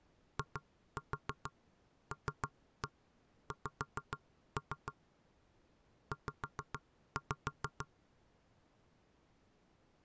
Tap code, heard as knocks on wood, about 6 knocks a second. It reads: ILX Z